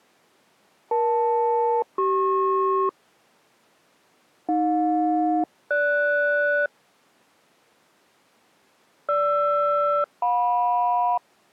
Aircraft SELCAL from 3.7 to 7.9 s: AJ-GS

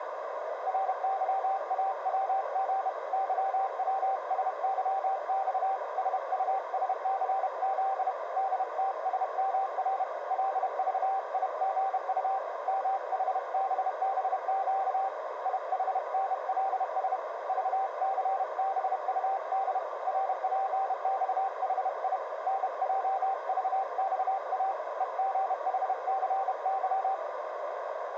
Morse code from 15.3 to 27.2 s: IHNLS VCBUD RPXHI NJVXA EGHCY

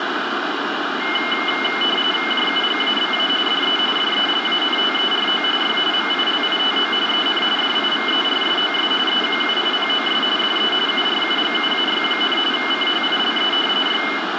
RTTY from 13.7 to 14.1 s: Y

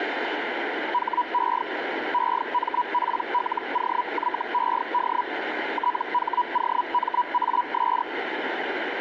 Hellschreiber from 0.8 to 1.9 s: HE

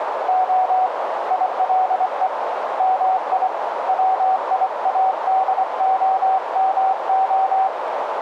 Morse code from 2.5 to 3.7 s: MI

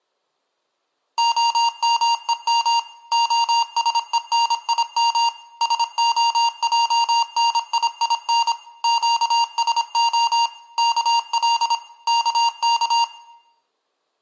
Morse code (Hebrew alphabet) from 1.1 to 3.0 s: המום

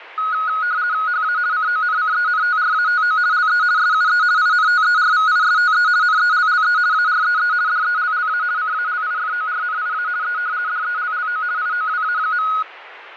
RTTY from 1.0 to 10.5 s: HA CONCENTRATO LE SUE INTERVISTE NELLE AREE DELLA CALIFORNIA E

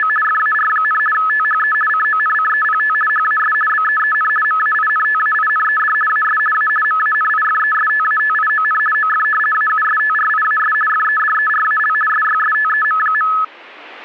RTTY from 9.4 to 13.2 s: AUSTRIAS FEDERAL SYSTEM.

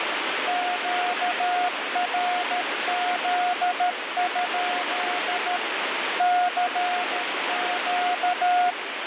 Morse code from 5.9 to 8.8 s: CQ

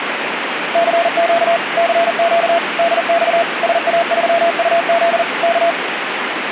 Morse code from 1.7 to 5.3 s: CQ DX SA3UZ

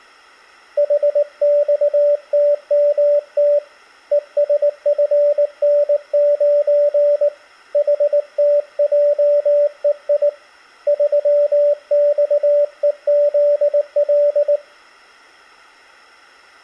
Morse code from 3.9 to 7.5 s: ESFN9

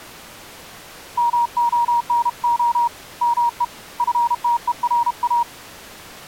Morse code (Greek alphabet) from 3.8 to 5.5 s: ΦΤΕΡΑ

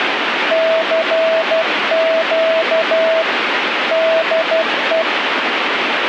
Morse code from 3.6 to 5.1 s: DE

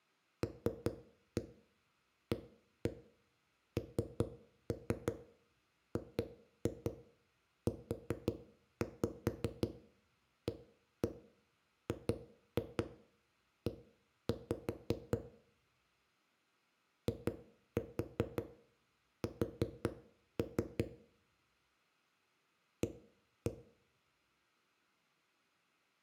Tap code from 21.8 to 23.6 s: A

